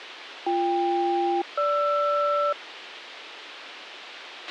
Aircraft SELCAL, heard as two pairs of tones, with radio hiss and a squelch burst at the end. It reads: BK-GR